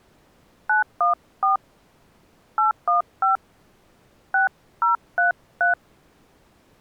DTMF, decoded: 914 815 6033

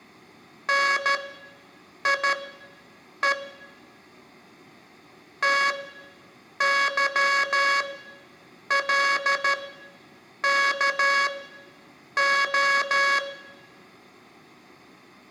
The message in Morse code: NIE TYLKO

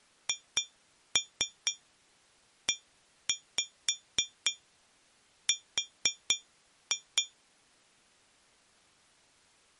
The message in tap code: HER

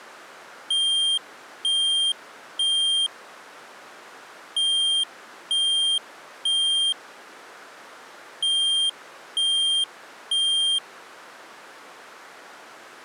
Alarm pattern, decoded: temporal three

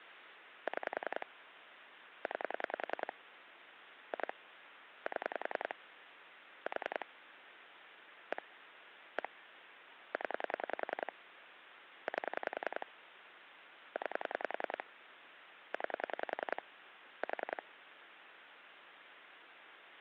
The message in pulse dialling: 6 9 2 7 4 1 1 0 8 9 9 4

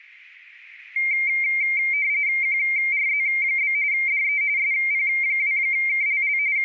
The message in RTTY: QRZ? DE SP2KLL …

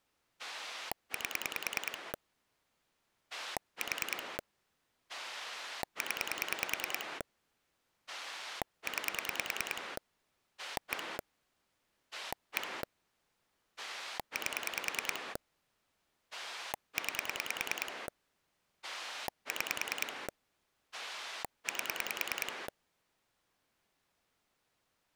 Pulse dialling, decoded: 8 4 0 9 1 1 8 9 6 8

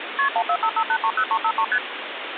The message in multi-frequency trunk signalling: KP 1455830353 ST

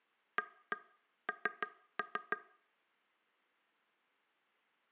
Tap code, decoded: AN

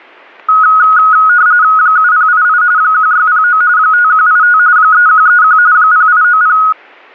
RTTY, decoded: 7088 1609 5185 3131 0890

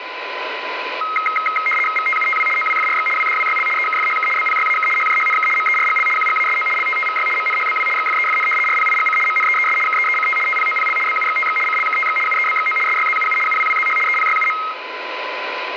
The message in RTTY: VTUTW OWFRX WDWYL EKFHK BPYAK HJHNK MERGL QGASO LTTVY MNHBW XFEFN RPIGC MNEES KEECT TPOPL BUXTX CLKTX UEBXO SYZUU UWWZH EPYUM

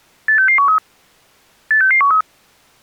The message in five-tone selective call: 86613 86613

